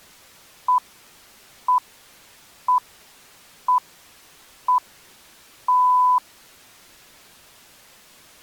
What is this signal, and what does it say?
Radio time signal (six pips, as the Greenwich Time Signal), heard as pips.